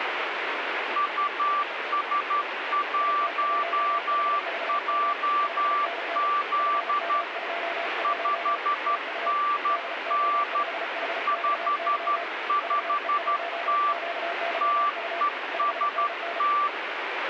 Morse code, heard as two keyed tones, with heavy radio static. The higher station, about 12 wpm, 1170 Hz: US1JZ 5NN 55T TEST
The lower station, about 34 wpm, 690 Hz: IT1HVM 5NN FM21 TU DO5HXY VE1QYU 5NN